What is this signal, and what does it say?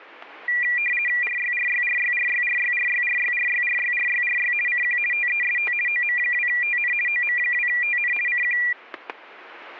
RTTY (50 baud, 450 Hz shift), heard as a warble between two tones, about 2150 Hz centre, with static crashes. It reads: RYRYRYRYRYRYRYRYRYRYRY CQ TEST OM2TN OM2TN CQ